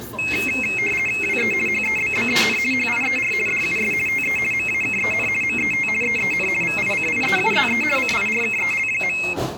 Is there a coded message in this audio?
Yes: RTTY (50 baud, 450 Hz shift) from 0.2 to 9.3 s, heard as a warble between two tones, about 2350 Hz centre, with the noise of a restaurant. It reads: WE HEBBEN HIER DUS TE MAKEN MET EEN VICIEUZE CIRKEL.